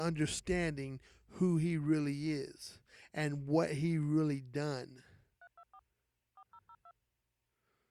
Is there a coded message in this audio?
Yes: DTMF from 5.4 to 6.9 s, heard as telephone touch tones, dialled by machine, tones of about 60 ms. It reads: 324 4002